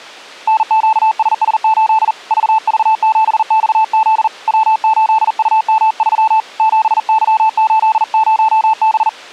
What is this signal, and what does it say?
Morse code, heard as a keyed tone, hand-sent with a paddle, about 40 wpm, 880 Hz. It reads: NQSS8 VV7XZ W8UM3 7Y80B